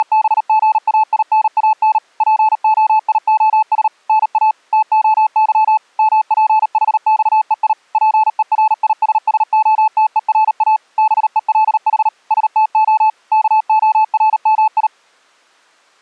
Morse code (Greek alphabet), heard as a keyed tone, machine-sent, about 38 wpm, 870 Hz. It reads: … ΠΟΙΟΣ ΝΑ ΤΟΥ ΜΠΗΞΕΙ ΠΕΡΙΣΣΟΤΕΡΑ ΒΕΛΗ ΣΤΟ ΚΟΡΜΙ